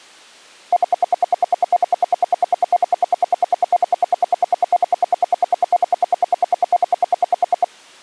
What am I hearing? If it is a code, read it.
Radio time signal (RWM, Moscow), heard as ten pulses a second.